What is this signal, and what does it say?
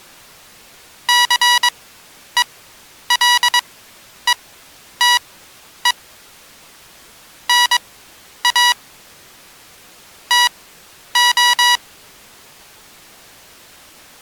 Morse code (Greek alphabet), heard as electronic beeps, machine-sent, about 22 wpm, spaced as for 10 wpm, 970 Hz. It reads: ΘΕΛΕΤΕ ΝΑ ΤΟ